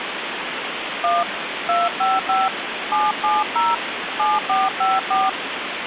DTMF, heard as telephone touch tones, dialled by hand, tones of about 190 ms, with phone line noise. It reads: 1 255 770 7454